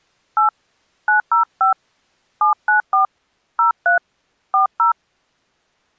DTMF, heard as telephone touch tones, dialled by hand, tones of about 120 ms. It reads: 8 905 794 03 40